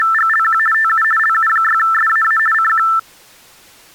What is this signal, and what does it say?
RTTY (50 baud, 450 Hz shift), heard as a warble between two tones, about 1550 Hz centre. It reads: … TU LU6SAA CQ